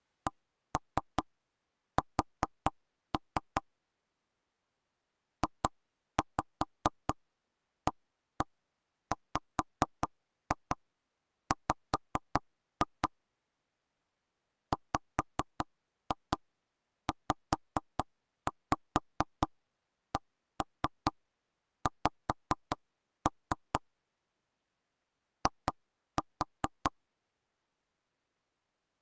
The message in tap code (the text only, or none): CS JAWW WZCX I